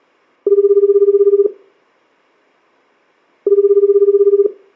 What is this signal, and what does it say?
Telephone call progress tone (Japanese plan), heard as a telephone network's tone, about 380, 400, 420 Hz, 1 s on and 2 s off, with room echo. Ringback tone.